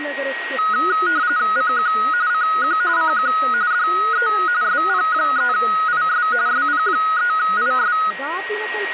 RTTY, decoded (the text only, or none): CQ CQ CQ DE SP3IS SP3IS